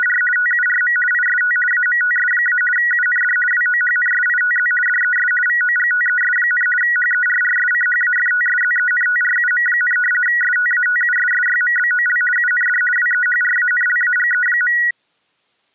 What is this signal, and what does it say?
RTTY (50 baud, 450 Hz shift), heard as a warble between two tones, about 1700 Hz centre. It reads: … TURM IST AMTS- UND WOHNSITZ DES VOGTES, HERRSCHAFTSZENTRUM, STATUSSYMBOL UND WEHRANLAGE.